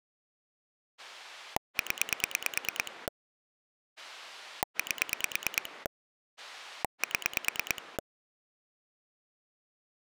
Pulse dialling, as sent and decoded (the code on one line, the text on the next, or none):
10 / 8 / 7
0 8 7